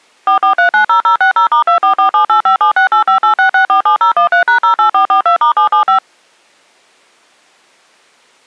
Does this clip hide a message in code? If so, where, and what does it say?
Yes: DTMF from 0.3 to 6.0 s, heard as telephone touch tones, dialled by machine, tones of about 110 ms. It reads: 44390060*244785768586647013#08442*775